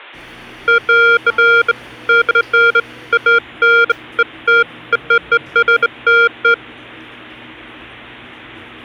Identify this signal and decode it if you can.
Beeps of irregular length, with the noise of a cafe. There is no code.